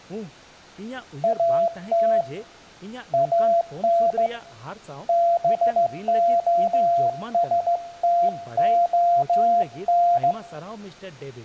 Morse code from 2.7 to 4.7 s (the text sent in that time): AN